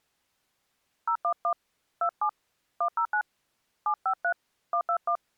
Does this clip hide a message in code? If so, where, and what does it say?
Yes: DTMF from 1.1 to 5.2 s, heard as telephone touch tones, dialled by hand, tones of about 80 ms. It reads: 011 27 109 753 121